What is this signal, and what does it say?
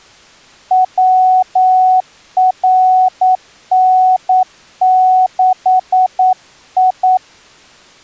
Morse code, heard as a keyed tone, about 9 wpm, 740 Hz. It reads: WRN6I